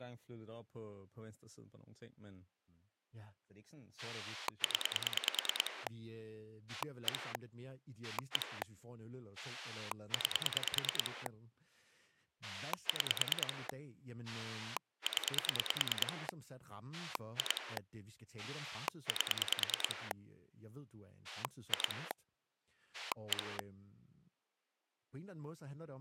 Pulse dialling, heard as a rotary dial, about 9 pulses a second, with speech in Danish. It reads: 0 1 1 9 6 0 2 8 2 1